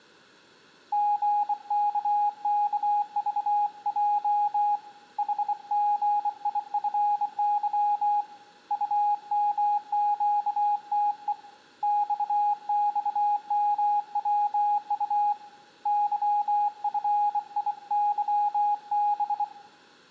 Morse code, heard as a keyed tone, hand-sent with a bug key, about 24 wpm, 830 Hz, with room echo. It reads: GKKVJ HGIFY UMQTE XXMWU YFIYB